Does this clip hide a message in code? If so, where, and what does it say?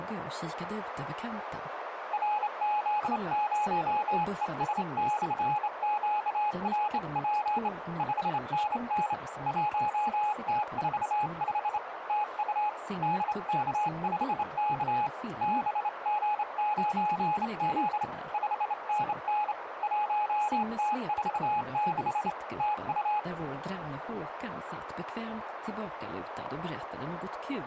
Yes: Morse code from 2.1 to 23.3 s, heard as a keyed tone, hand-sent with a straight key, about 28 wpm, 840 Hz, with radio static and a narrow filter. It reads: RZ0ES/QRP 5NN 1T45 TU DK5K BG9Z 5NN 1T46 TU